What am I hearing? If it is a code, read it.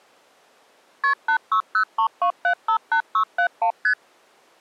Multi-frequency trunk signalling (R1, as on North American trunks), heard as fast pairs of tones, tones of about 90 ms. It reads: KP 86032758671 ST